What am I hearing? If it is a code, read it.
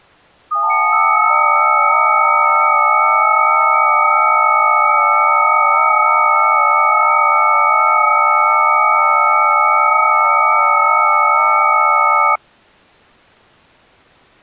FT8 (several signals at once), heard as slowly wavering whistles, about 6.25 baud.